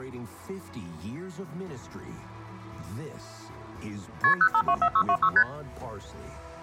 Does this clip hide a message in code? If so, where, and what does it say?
Yes: multi-frequency trunk signalling (R1, as on North American trunks) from 4.2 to 5.4 s, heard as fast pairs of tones, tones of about 70 ms. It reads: KP 0524626 ST